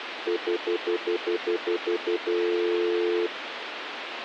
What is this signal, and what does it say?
Telephone call progress tone (North American plan), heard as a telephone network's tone, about 350, 440 Hz, 0.1 s on and 0.1 s off, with phone line noise. Stutter dial tone.